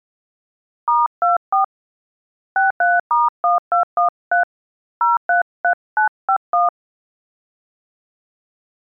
DTMF, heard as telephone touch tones, dialled by hand, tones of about 140 ms. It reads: *24 63*1213 033951